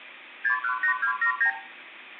Multi-frequency trunk signalling (R2, with the far end's replies), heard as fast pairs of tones, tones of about 100 ms, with room echo. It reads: 618279